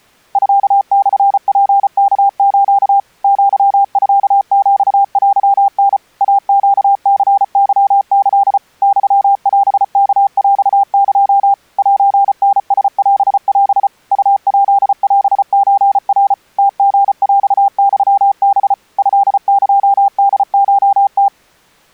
Morse code (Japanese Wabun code), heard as a keyed tone, machine-sent, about 34 wpm, 800 Hz. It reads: ミモツワス アミヒテタ イネニケキ ユオワヰエ セタラオオ ウヱオソナ ムリヰユハ トエホコム